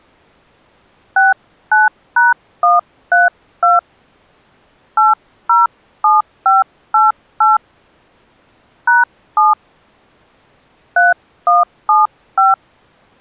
DTMF, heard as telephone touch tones, dialled by hand, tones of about 170 ms. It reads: 69#132 807588 #7 3175